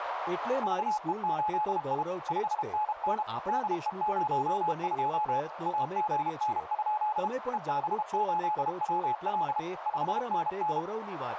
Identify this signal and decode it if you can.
Morse code, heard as a keyed tone, machine-sent, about 32 wpm, 850 Hz, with radio static, a narrow filter and speech in Gujarati. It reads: VE8I 5NN DE02 AGN? EB8WL 5NN